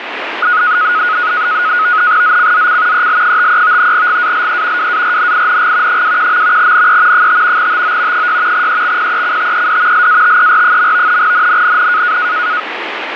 NAVTEX (SITOR-B), 100 baud, 170 Hz shift, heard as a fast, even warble, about 1360 Hz centre, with radio static. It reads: ZCZC EL53 GALE WARNING 21. NE 5 TO 6 EXPECTED LATER. NNNN